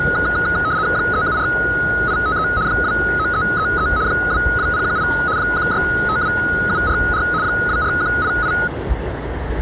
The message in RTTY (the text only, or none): 374853 29333 22018 1652744 24188